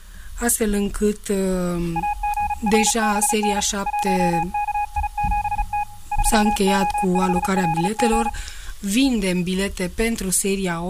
Morse code, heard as a keyed tone, hand-sent with a paddle, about 35 wpm, 830 Hz. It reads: AGRBN 1KI7T 3O5LG